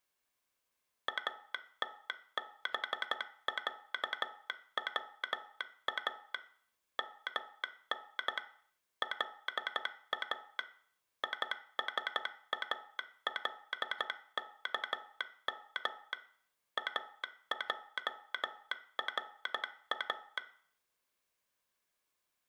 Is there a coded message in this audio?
Yes: Morse code (Arabic alphabet) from 1.0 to 20.4 s, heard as a telegraph sounder, machine-sent, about 13 wpm, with room echo. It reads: اتبعوا من لا يسالكم اجرا